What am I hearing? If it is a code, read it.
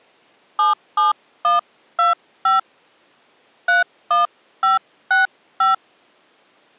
DTMF, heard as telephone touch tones, dialled by hand, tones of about 150 ms. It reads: 77125 31565